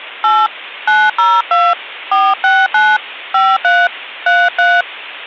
DTMF, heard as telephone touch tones, dialled by hand, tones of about 220 ms. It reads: 8 902 469 53 33